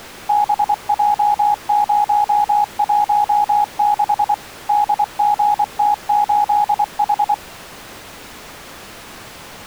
Morse code, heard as a keyed tone, machine-sent, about 24 wpm, 830 Hz. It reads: BJ016 DGT8H